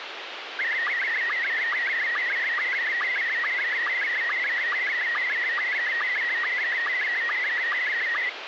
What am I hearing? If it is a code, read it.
SSTV (slow-scan television), Scottie S1, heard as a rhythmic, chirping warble, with radio hiss.